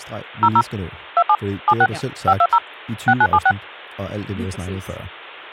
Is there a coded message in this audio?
Yes: DTMF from 0.4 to 3.5 s, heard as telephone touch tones, dialled by machine, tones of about 60 ms, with hum and speech in Danish. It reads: 00 27 76 520 6976